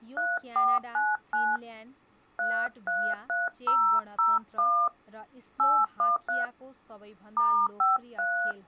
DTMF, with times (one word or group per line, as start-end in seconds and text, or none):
0.2-1.6 3499
2.4-4.9 333001
5.6-6.4 813
7.4-8.5 *53